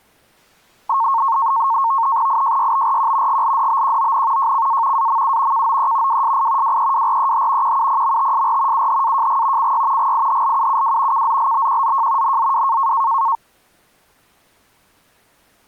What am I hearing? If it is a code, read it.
NAVTEX (SITOR-B), 100 baud, 170 Hz shift, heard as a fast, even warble, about 1000 Hz centre. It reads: IJYBRQ GLDBQON JCA AMU KOE WSI WEWREH QUPMTSR UHAJG CY GIHLUUW KZLBQZJ NZW